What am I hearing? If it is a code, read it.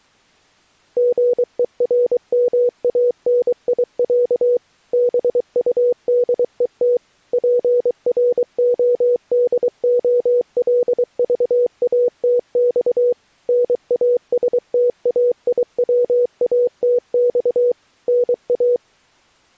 Morse code (Russian alphabet), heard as a keyed tone, machine-sent, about 23 wpm, 490 Hz. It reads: ГЕРМАНИЯ БУДЕТ ПРОДОЛЖАТЬ НАСТАИВАТЬ НА